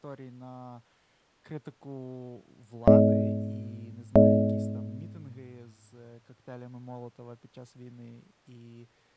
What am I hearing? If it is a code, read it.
Clock strike, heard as a bell, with speech in Ukrainian. 2. Two o'clock.